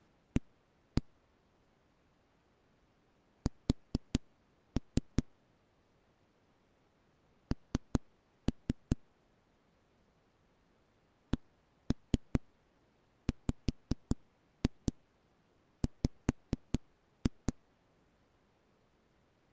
Tap code, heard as knocks on a wall, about 5 knocks a second. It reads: A S N CWW